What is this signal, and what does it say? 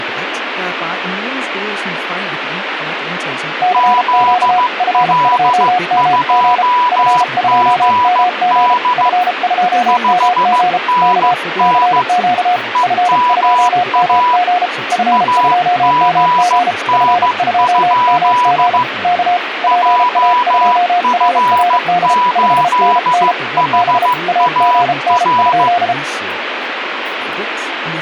Morse code, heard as two keyed tones, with radio static and speech in Danish. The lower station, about 33 wpm, 720 Hz: CQ F2MG F2MG F2MG K CQ F2MG F2MG F2MG K PA2RRD 5NN EB AGN?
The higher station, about 15 wpm, 980 Hz: ZL2GD 5NN EMA AGN? JF8HAR